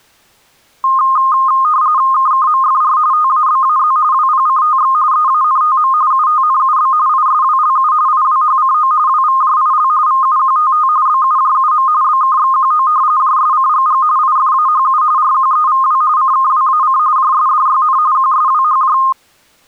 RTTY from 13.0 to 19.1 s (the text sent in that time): JSCGG IFAHU RQEVW CKWAC JSDYN QSWHJ